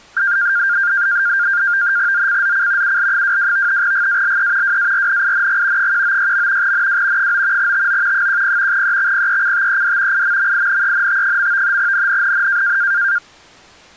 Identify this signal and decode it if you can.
NAVTEX (SITOR-B), 100 baud, 170 Hz shift, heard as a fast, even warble, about 1500 Hz centre. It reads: ZCZC UL22 GALE WARNING 196. NW 9 TO 10 EXPECTED IMMINENT. NNNN